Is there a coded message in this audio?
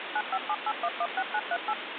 Yes: DTMF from 0.2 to 1.7 s, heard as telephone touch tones, dialled by machine, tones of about 50 ms, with phone line noise. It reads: 9578116938